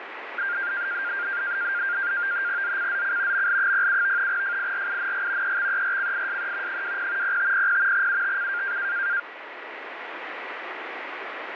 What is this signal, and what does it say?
NAVTEX (SITOR-B), 100 baud, 170 Hz shift, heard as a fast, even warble, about 1500 Hz centre, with radio static. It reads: ZCZC ML07 FIRING EXERCISE 20 0500 UTC